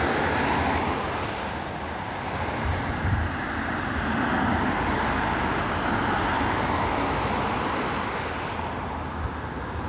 Street noise. There is no code.